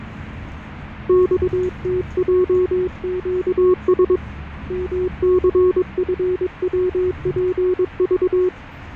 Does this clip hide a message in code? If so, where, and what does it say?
Yes: Morse code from 1.0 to 8.5 s, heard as a keyed tone, hand-sent with a paddle, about 22 wpm, 370 Hz, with fading and the noise inside a bus. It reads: XTJQS MCFWPV